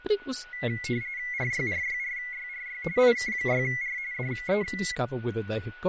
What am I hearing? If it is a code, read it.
RTTY (45.45 baud, 170 Hz shift), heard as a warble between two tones, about 2050 Hz centre, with a steady whistle near 1470 Hz and speech in English. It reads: RYRYRYRY IK6R DE